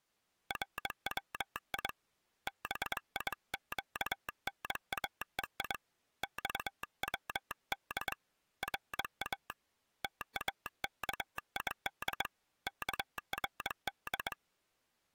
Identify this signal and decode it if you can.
Morse code (Persian alphabet), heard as a telegraph sounder, hand-sent with a straight key, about 22 wpm. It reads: روی بیگناهی خود را تاکید کرد